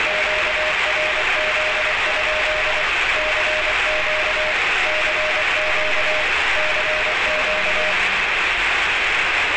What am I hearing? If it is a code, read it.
Morse code, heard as a keyed tone, machine-sent, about 24 wpm, 620 Hz, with heavy radio static and street noise. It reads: QRZ? CQ CQ CQ